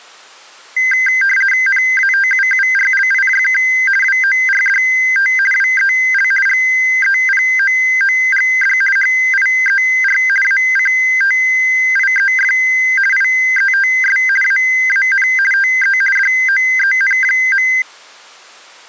RTTY (50 baud, 450 Hz shift), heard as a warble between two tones, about 1800 Hz centre. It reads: NATUURLIJK WORDT WEL GEPOOGD HIER ACTIEF IETS AAN TE DOEN.